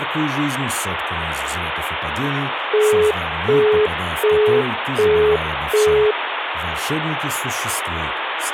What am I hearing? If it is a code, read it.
Telephone call progress tone (as in the UK, Australia and similar networks), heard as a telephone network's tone, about 420 Hz, 0.375 s on and 0.375 s off, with phone line noise and speech in Russian. Busy tone.